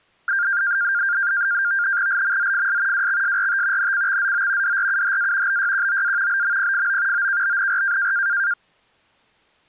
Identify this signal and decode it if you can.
NAVTEX (SITOR-B), 100 baud, 170 Hz shift, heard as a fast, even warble, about 1500 Hz centre. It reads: LMZFS WXSRT NCXZO DRUHA BYQOA BMPFO OKBNR